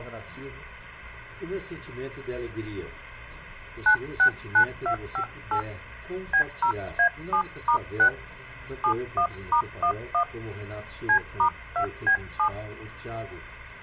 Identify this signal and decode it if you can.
DTMF, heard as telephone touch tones, dialled by hand, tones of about 90 ms, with hum. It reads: 969258 B0A7*6 71*11 C*2B7